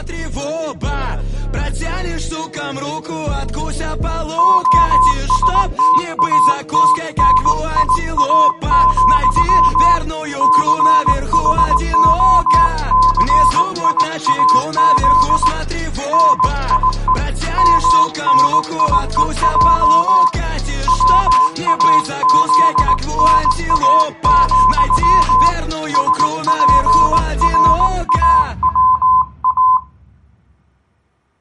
Morse code, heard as a keyed tone, hand-sent with a paddle, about 19 wpm, 1020 Hz. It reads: OSTATNIA, CHOCIAZ NIE MNIEJ WAZNA, SPRAWA